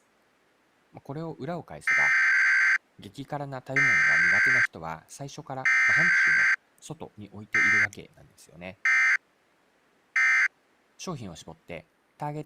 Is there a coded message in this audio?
Yes: Emergency Alert System (SAME) tones (header bursts, then end-of-message bursts) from 1.9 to 10.5 s, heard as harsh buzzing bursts, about 520.83 baud, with speech in Japanese.